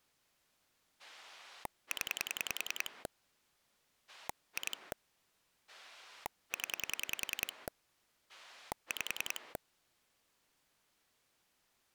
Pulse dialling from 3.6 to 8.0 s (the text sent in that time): 2 0